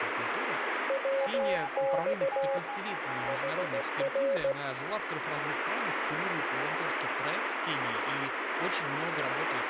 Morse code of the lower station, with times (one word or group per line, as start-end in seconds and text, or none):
0.9-2.6 WX
3.3-4.5 HR